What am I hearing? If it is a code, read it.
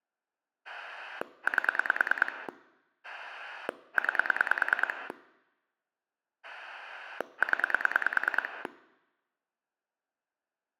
Pulse dialling, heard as a rotary dial, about 9 pulses a second. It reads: 8 9 0